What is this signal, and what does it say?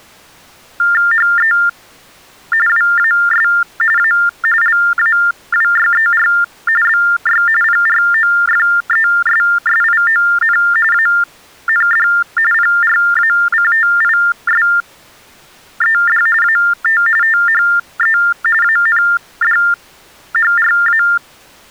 TTY/TDD text telephone tones (45.45 baud Baudot), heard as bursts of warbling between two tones, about 400 Hz shift, 1600 Hz centre. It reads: HE WAS A LAWYER BY PROFESSION AND PRACTISED AT THE ANDHRA